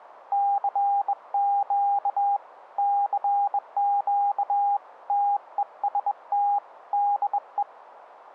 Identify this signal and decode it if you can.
Morse code, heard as a keyed tone, hand-sent with a bug key, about 21 wpm, 810 Hz. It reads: CQ CQ TEST DE